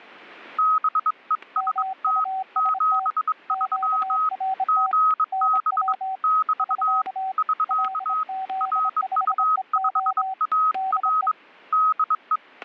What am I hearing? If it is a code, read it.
Morse code, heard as two keyed tones, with static crashes. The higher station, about 22 wpm, 1270 Hz: BEST 73 GB <BT> <SK> RU5AR DE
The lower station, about 26 wpm, 760 Hz: MUST QRT NW <SK> LZ5EO DE